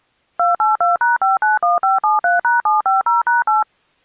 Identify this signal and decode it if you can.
DTMF, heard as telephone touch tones, dialled by machine, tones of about 150 ms. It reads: 282#591573#750#8